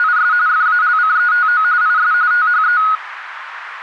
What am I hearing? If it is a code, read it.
RTTY (45.45 baud, 170 Hz shift), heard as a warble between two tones, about 1360 Hz centre, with radio static. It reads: … FALCETO IS THE